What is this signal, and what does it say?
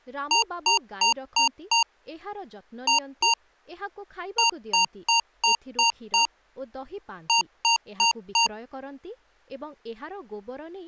Beep code, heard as beeps from a small speaker, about 930 Hz, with speech in Odia. 5-2-6-4.